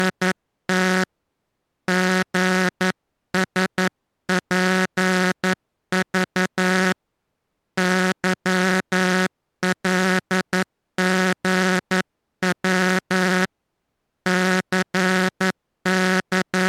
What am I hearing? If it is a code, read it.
Morse code, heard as a buzzer, hand-sent with a paddle, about 11 wpm. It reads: … GSPV YLGW …